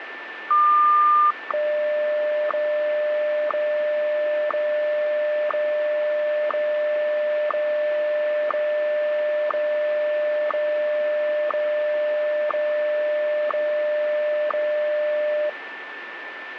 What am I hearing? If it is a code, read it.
Radio time signal (WWVH, Hawaii), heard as ticks, one a second, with radio static and a steady whistle near 1770 Hz.